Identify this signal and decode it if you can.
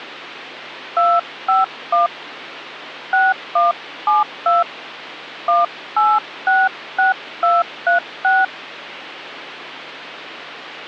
DTMF, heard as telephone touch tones, dialled by hand, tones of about 180 ms, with hum. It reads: 251 6172 1866236